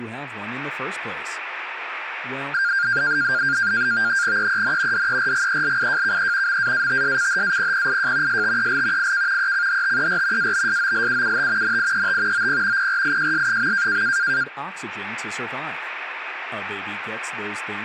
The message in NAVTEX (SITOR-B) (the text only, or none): EEN DERGELIJKE MAATSCHAPPIJ STEL IK ECHTER ABSOLUUT NIET OP PRIJS.